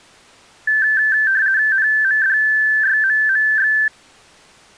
RTTY (50 baud, 170 Hz shift), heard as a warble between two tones, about 1650 Hz centre. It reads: NMDYMMX